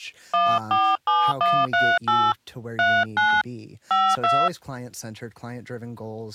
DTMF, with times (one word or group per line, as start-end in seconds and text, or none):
0.3-2.3 147138
2.8-3.4 39
3.9-4.5 52